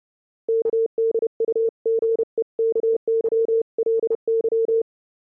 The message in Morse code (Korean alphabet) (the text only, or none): 의사에게